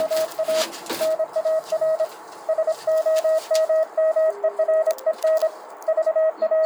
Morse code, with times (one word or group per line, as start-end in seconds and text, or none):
0.0-0.6 …
1.0-2.0 NAR
2.5-5.5 SOMMEREN
5.9-6.7 …